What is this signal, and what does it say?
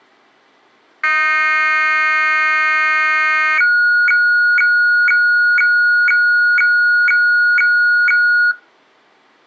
Weather fax (radiofax), 120 lines a minute, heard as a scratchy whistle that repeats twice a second.